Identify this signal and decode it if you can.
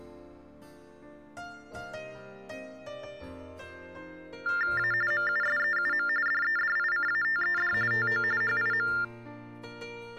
TTY/TDD text telephone tones (45.45 baud Baudot), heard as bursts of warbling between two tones, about 400 Hz shift, 1600 Hz centre. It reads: A MUSEUM DEDICATED TO HIM